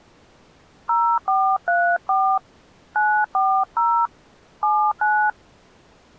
DTMF, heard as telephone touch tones, dialled by hand, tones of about 290 ms. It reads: 0434 940 79